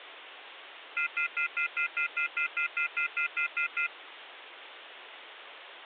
Telephone call progress tone (North American plan), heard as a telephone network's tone, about 1400, 2050, 2450, 2600 Hz, 0.1 s on and 0.1 s off, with phone line noise. Off-hook warning tone.